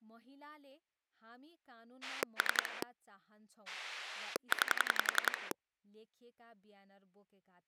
Pulse dialling, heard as a rotary dial, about 11 pulses a second, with speech in Nepali. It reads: 3 9